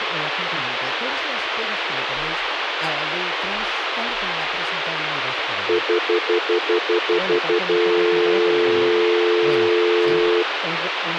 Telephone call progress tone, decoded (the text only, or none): stutter dial tone